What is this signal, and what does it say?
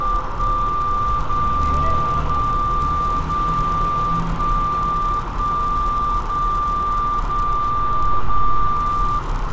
Radio time signal (DCF77), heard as a tone whose level steps once a second, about 1180 Hz, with radio static, a narrow filter, room echo and street noise. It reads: 1 0 0 0 1 1 0 0 0